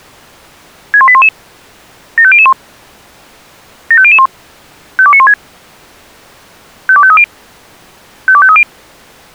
Five-tone selective call (ZVEI), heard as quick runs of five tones, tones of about 70 ms. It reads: 61811 75001 75001 52916 52530 52530